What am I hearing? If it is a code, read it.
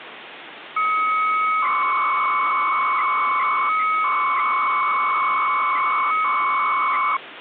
300-baud modem data (Bell 103 tones), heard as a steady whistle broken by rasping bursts, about 300 baud, 200 Hz shift, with phone line noise.